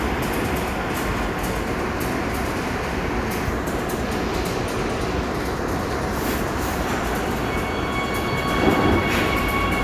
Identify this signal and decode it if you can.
The noise of a subway station. There is no code.